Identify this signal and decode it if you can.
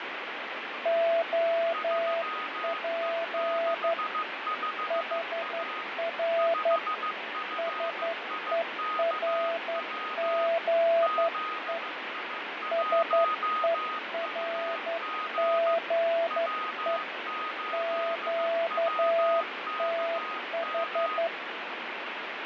Morse code, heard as two keyed tones, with heavy radio static and fading. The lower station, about 11 wpm, 670 Hz: OP HR SERGE SERGE QTH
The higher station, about 15 wpm, 1250 Hz: 3E65A 5FIKW ZI1UG W8WKM